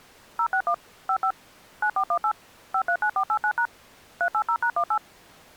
DTMF, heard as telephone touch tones, dialled by machine, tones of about 80 ms. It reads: 061 55 9418 539489# 380#18